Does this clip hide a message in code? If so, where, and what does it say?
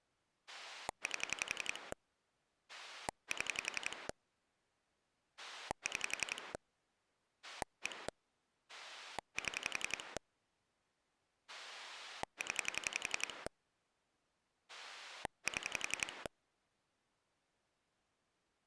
Yes: pulse dialling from 0.5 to 16.3 s, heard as a rotary dial, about 11 pulses a second. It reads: 8 7 6 1 7 0 7